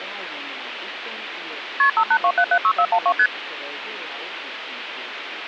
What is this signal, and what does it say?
Multi-frequency trunk signalling (R1, as on North American trunks), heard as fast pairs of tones, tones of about 70 ms, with phone line noise. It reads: KP 582776412 ST